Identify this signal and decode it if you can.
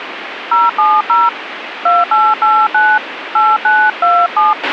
DTMF, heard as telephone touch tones, dialled by hand, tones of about 200 ms, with radio hiss and a squelch burst at the end. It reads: 070 2889 8927